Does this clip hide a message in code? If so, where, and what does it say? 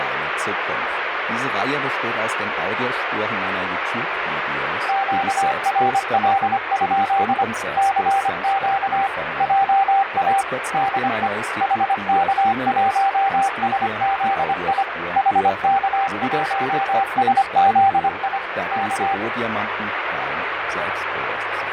Yes: Morse code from 4.8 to 19.2 s, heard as a keyed tone, machine-sent, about 25 wpm, 780 Hz, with radio static. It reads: QRL? CQ JA DE HK1SZI HK1SZI K